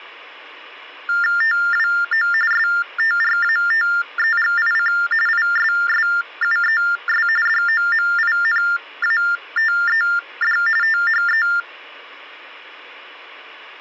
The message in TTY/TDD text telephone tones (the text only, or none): TWO STRATEGIC ISSUES DOMINATED THE